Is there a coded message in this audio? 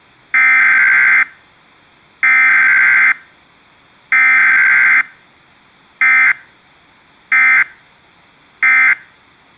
Yes: Emergency Alert System (SAME) tones (header bursts, then end-of-message bursts) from 0.3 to 8.9 s, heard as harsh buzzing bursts, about 520.83 baud.